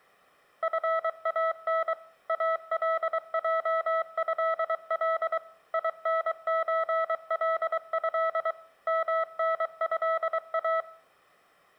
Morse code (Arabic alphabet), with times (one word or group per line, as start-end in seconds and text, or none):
0.6-1.9 فان
2.3-5.4 الجهل
5.7-8.5 ينزله
8.9-10.8 منها